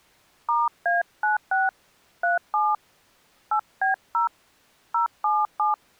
DTMF, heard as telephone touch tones, dialled by hand, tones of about 150 ms. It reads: *A96 37 8B0 077